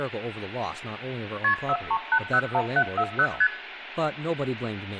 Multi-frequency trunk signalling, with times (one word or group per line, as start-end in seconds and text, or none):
1.4-1.5 KP
1.7-3.3 43801740
3.4-3.5 ST